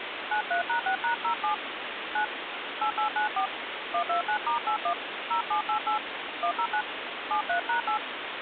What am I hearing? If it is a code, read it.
DTMF, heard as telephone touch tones, dialled by hand, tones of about 100 ms, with phone line noise. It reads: 93#6#07 9 8894 129*81 0788 109 73#8